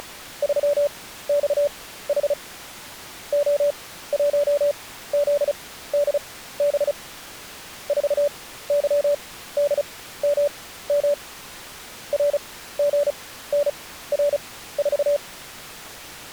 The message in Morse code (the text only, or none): … O1ZDB 4YDMM RGNR4